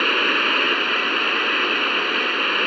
Morse code, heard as a keyed tone, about 21 wpm, 730 Hz, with radio static, a weaker station near 1960 Hz and room echo. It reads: 73